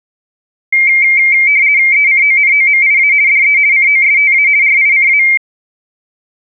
RTTY (50 baud, 170 Hz shift), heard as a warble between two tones, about 2200 Hz centre. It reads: ECONOMIA DE COSTA RICA